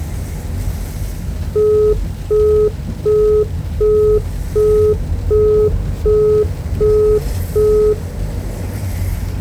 Telephone call progress tone (as in the UK, Australia and similar networks), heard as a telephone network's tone, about 420 Hz, 0.375 s on and 0.375 s off, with the noise inside a car. Busy tone.